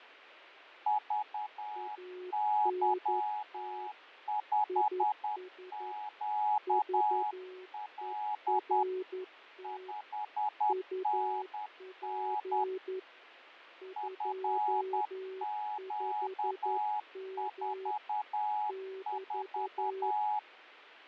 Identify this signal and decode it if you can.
Morse code, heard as two keyed tones, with radio static and fading. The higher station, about 10 wpm, 840 Hz: VY5QL 5NN FQ44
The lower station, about 11 wpm, 370 Hz: ANT IS VERT UP 25M <BT>